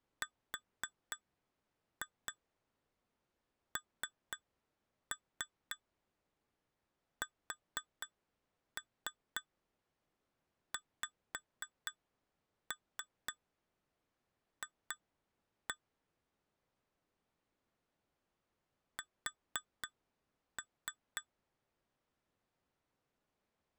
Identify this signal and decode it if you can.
Tap code, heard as taps on glass, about 4 knocks a second. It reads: RNSXF S